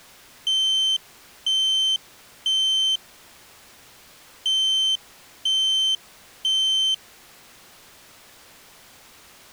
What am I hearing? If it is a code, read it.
Alarm pattern, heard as an alarm's beeps, played twice, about 3100 Hz. Temporal three. Smoke or fire, evacuate.